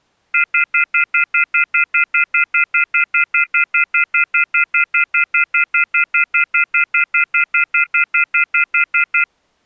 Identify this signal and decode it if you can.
Telephone call progress tone (North American plan), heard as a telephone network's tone, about 1400, 2050, 2450, 2600 Hz, 0.1 s on and 0.1 s off. Off-hook warning tone.